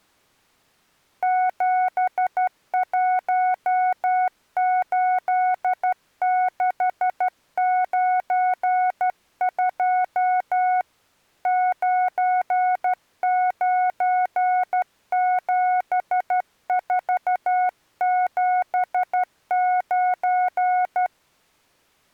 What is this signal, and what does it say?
Morse code, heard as a keyed tone, hand-sent with a straight key, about 12 wpm, 730 Hz. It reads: 718692 997479